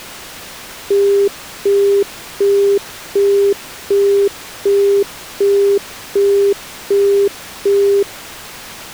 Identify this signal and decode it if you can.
Telephone call progress tone (as in the UK, Australia and similar networks), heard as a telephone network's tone, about 400 Hz, 0.375 s on and 0.375 s off. Busy tone.